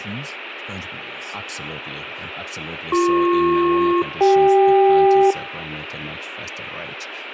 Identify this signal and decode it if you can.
Aircraft SELCAL, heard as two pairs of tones, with radio hiss, room echo and speech in English. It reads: BP-CK